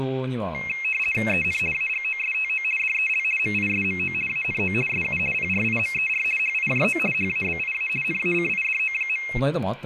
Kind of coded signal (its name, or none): RTTY